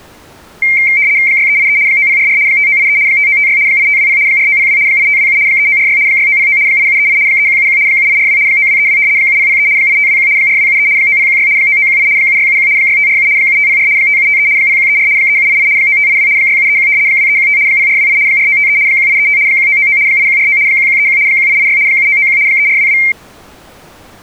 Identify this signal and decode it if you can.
RTTY (75 baud, 170 Hz shift), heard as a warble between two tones, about 2200 Hz centre. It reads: 6383 9044 5983 5956 8520 4902 8527 3946 6909 8738 3171 7842 9232 7003 8521 4273 9016 9918 7671 6547 7504 5753 0134 3788 9582 6731 2315 0428 4953 1835 1999 8149 1131 1886 7991 3422